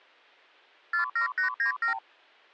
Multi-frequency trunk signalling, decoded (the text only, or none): 47897